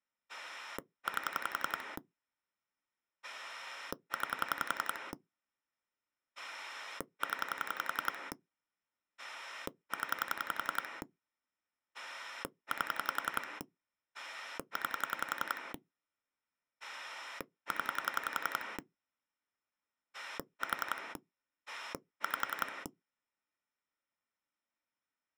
Pulse dialling, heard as a rotary dial, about 11 pulses a second. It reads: 8 9 0 0 8 9 0 4 5